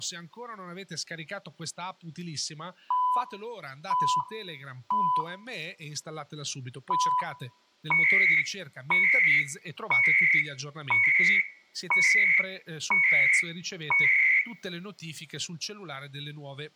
Radio time signal (CHU, Canada), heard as beeps and data bursts, one a second, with room echo and speech in Italian.